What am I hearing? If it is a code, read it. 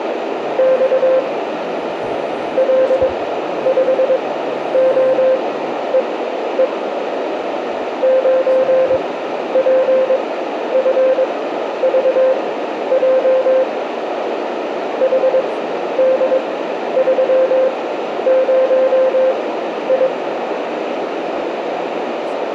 Morse code, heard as a keyed tone, machine-sent, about 22 wpm, spaced as for 11 wpm, 520 Hz, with radio static and a narrow filter. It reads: … L5OEE 9PFVJ HD30I